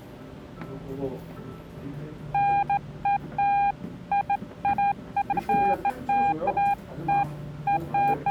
Beeps of irregular length, with the noise of a cafe. There is no code.